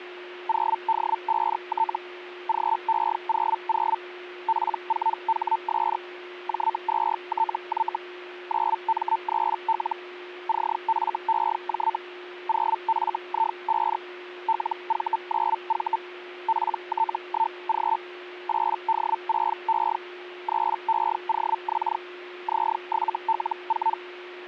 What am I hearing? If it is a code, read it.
Hellschreiber (Feld-Hell, 122.5 baud), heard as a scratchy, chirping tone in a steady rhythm, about 900 Hz, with a steady whistle near 360 Hz. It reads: 0D5T GE00 P4HS J2TY 9M3L CFEJ 0FI5 LV9V PT1G 8D6E 3EOX Z7L4